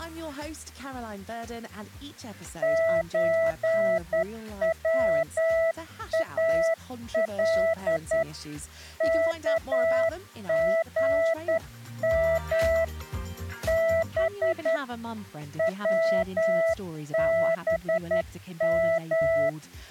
Morse code (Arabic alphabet), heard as a keyed tone, hand-sent with a straight key, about 10 wpm, 660 Hz. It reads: زوال كغم ب …